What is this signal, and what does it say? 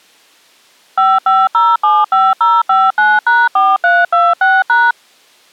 DTMF, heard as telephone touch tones, dialled by machine, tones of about 210 ms. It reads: 55075059#4326#